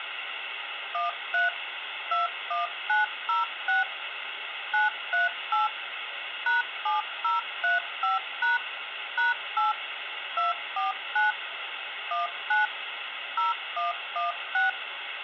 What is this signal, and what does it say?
DTMF, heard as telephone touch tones, dialled by machine, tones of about 150 ms, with phone line noise. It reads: 13 21906 938 #7035# #8 249 19 0116